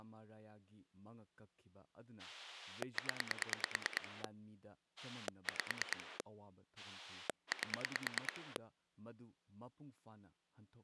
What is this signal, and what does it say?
Pulse dialling, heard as a rotary dial, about 9 pulses a second, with speech in Manipuri. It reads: 0 5 8